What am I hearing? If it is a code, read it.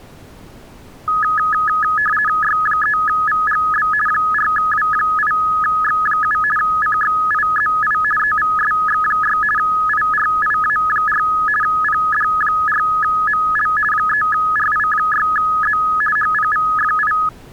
RTTY (50 baud, 450 Hz shift), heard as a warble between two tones, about 1480 Hz centre. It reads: Y3VGB 4W8X7 CXIZI EVSX6 IRIA4 PD4ML 3RI6Z HPVFI